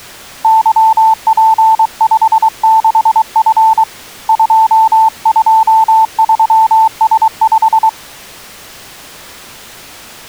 Morse code, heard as a keyed tone, hand-sent with a paddle, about 23 wpm, 890 Hz. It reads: YP56F 223S5